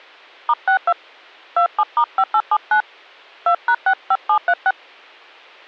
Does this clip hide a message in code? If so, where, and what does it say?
Yes: DTMF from 0.5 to 4.7 s, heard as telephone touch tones, dialled by hand, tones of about 70 ms. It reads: *62 27*5879 2#65736